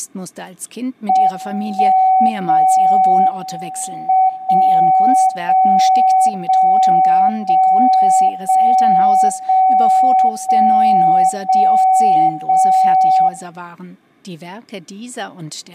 Radio time signal (WWVB), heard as a tone whose level steps once a second, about 750 Hz, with room echo. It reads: 1 0 M 0 0 0 0 0 0 0 0 0